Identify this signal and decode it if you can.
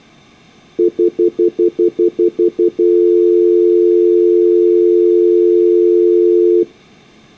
Telephone call progress tone (North American plan), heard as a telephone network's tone, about 350, 440 Hz, 0.1 s on and 0.1 s off. Stutter dial tone.